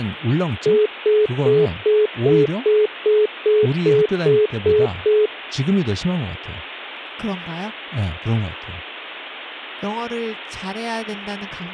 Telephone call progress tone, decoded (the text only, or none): congestion tone